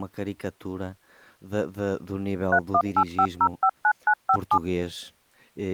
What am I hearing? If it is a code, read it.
DTMF, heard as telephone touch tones, dialled by machine, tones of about 70 ms, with speech in Portuguese. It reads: 3185059957